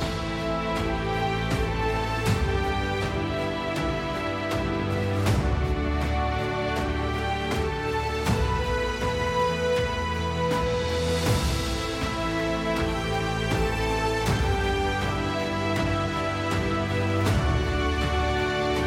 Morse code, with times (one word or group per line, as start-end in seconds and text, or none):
none